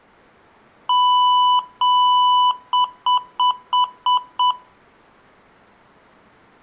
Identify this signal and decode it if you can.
Beep code, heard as beeps from a small speaker, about 990 Hz, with room echo. 2 long, 6 short.